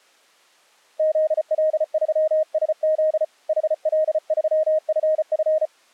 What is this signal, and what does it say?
Morse code, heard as a keyed tone, hand-sent with a paddle, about 34 wpm, 620 Hz. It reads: ZL3SZ HL3FF